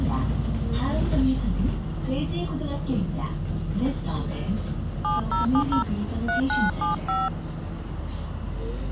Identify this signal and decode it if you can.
DTMF, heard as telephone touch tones, dialled by hand, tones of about 140 ms, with the noise inside a bus. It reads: 7070 3975